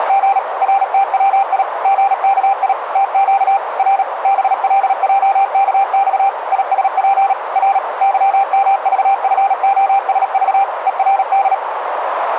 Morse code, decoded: … RTWI GKI TQ R BLJKX ISP R YMVFOSV ERD

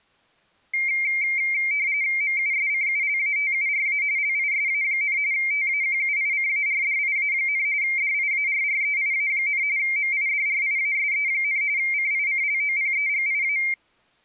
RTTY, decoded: MUSCULATURA LISA, TAQUICARDIA, DIARREIA, MIDRIASE, CICLOPEGIA

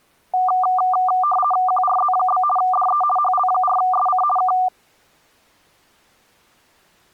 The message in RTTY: QRZ? DE HL4SC K

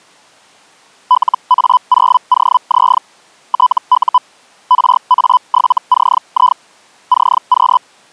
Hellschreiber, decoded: LA0OZ TU RA7CI CQ

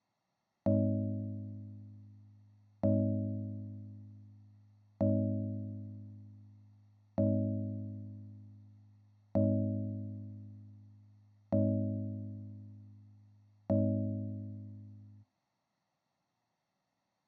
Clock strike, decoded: 7

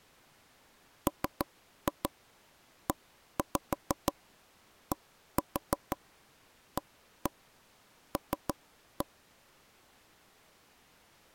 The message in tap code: MEDAL

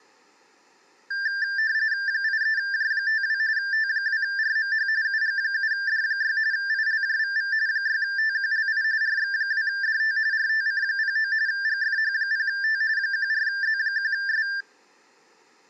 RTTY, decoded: 83J52 T2RMH UG7D6 ILJVV 6TQLI RX2DT RTC09 GFH0T 14Z1S

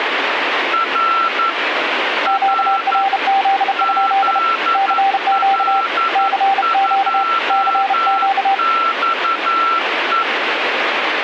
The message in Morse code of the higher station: R R ZL2XE

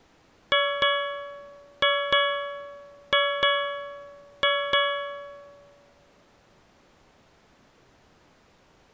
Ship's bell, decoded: 8

